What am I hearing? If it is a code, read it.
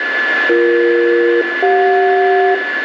Aircraft SELCAL, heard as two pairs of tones, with radio static, a steady whistle near 1730 Hz and room echo. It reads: BE-CJ